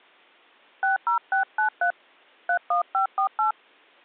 DTMF, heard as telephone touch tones, dialled by hand, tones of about 100 ms. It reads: 60693 31548